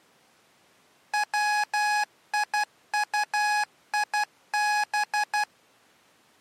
Morse code (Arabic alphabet), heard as electronic beeps, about 12 wpm, 840 Hz. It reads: ويطيب